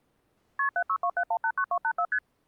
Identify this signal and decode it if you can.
Multi-frequency trunk signalling (R1, as on North American trunks), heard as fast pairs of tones, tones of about 70 ms. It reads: KP 7627189284 ST